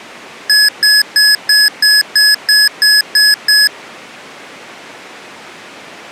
Beep code, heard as beeps from a small speaker, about 1700 Hz. 10 short. In AMI BIOS tables: CMOS shutdown register error.